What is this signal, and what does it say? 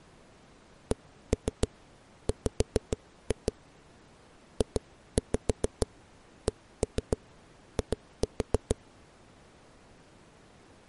Tap code, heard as knocks on a wall, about 6 knocks a second. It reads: CW JCI